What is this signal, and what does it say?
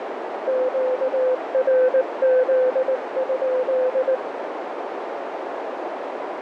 Morse code, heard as a keyed tone, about 19 wpm, 510 Hz, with heavy radio static and a narrow filter. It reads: QRZ?